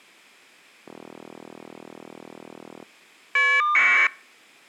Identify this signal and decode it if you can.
Caller ID data burst, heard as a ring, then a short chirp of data, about 1200 baud.